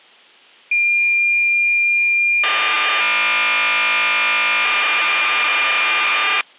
Cassette data (Kansas City type), 1200 baud, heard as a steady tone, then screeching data.